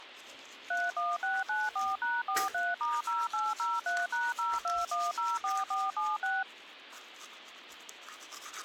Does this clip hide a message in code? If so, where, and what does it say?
Yes: DTMF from 0.7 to 6.4 s, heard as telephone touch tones, dialled by machine, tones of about 200 ms, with the noise of a restroom. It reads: 31694#43*0803#02104476